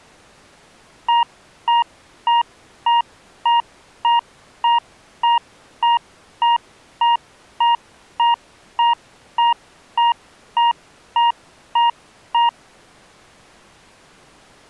Evenly repeated beeps. There is no code.